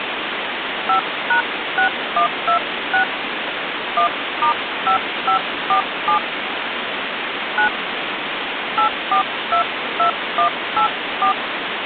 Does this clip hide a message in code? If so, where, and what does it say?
Yes: DTMF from 0.9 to 11.3 s, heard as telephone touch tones, dialled by hand, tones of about 100 ms, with phone line noise. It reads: 5#6126 1*5547 9 8422184